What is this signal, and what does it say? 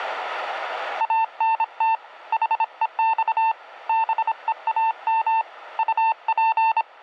Morse code, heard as a keyed tone, hand-sent with a paddle, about 26 wpm, 900 Hz. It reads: ANT HEX BEAM UP